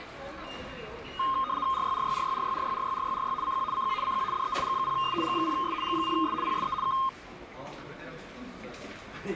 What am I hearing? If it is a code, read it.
RTTY (75 baud, 170 Hz shift), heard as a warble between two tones, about 1150 Hz centre, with the noise of a subway station. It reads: RYRYRYRYRYRYRYRY CQ CQ CQ DE G0S G0S G0S PSE K